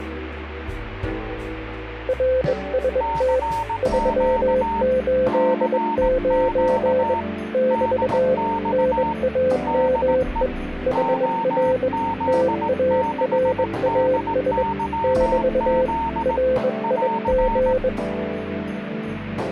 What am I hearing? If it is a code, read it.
Morse code, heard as two keyed tones. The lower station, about 21 wpm, 510 Hz: RST 389 <BT> NAME HR TARAS <BT> RIG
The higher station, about 18 wpm, 910 Hz: CQ CQ DX DE OZ6DYZ <AR>